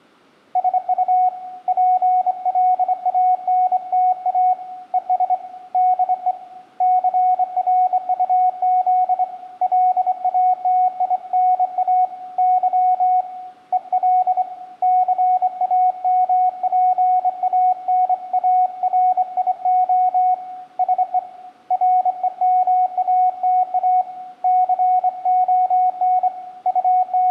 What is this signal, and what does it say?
Morse code, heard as a keyed tone, hand-sent with a straight key, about 25 wpm, 740 Hz, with room echo. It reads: SU PLANTA ES DE CRUZ LATINA Y EL CAMPANARIO SE REMATA CON …